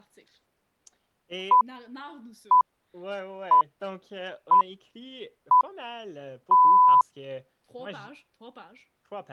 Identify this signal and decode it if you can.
Radio time signal (six pips, as the Greenwich Time Signal), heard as pips, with speech in French.